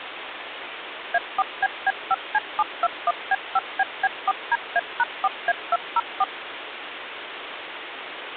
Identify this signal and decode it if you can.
DTMF, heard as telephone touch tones, dialled by machine, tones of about 40 ms, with phone line noise. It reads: A4BB5C721B5BB4DA#4A204